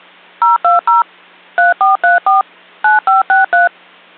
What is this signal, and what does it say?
DTMF, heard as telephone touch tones, dialled by machine, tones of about 150 ms. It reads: 020 3434 9563